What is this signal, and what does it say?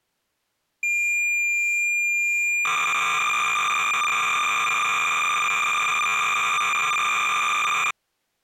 Cassette data (Kansas City type), 300 baud, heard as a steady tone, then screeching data.